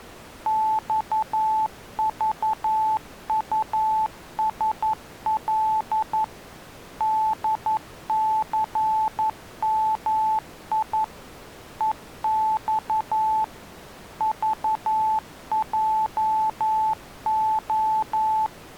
Morse code, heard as a keyed tone, machine-sent, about 11 wpm, 870 Hz. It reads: XVUSL DCMI EX VJO